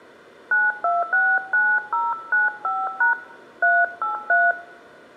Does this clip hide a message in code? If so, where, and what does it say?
Yes: DTMF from 0.5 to 4.5 s, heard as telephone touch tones, dialled by hand, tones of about 190 ms, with room echo. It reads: 9269095# 383